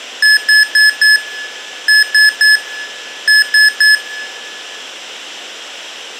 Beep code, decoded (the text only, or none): 4-3-3